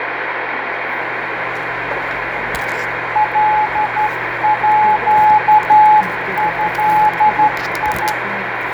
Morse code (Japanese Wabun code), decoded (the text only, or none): カード